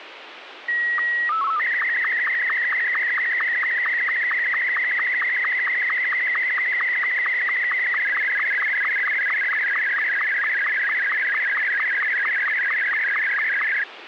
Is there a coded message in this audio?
Yes: SSTV (slow-scan television), Martin M2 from 0.7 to 13.8 s, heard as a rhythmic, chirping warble, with radio hiss.